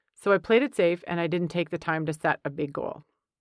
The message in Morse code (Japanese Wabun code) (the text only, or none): none